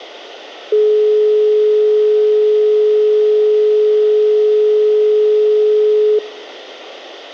Telephone call progress tone (425 Hz plan, as in most of Europe), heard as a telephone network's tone, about 420 Hz. Dial tone.